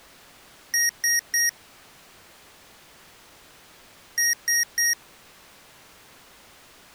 Beep code, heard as beeps from a small speaker, played twice, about 1900 Hz. 3 short. In AMI BIOS tables: failure in the first 64 KB of memory; in Dell tables: chipset error.